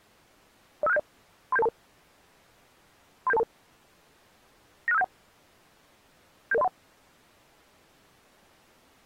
Five-tone selective call (EIA), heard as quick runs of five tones, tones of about 30 ms. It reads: 05670 37722 37722 96571 77031